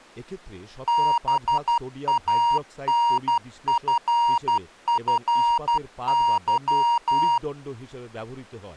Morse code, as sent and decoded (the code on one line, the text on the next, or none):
-... .- -. ..-. ..-. -.--
BANFFY